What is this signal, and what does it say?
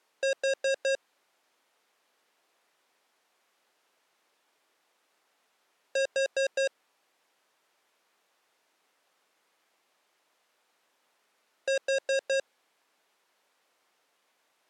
Alarm pattern, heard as an alarm's beeps, played three times, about 540 Hz. Temporal four. Carbon monoxide.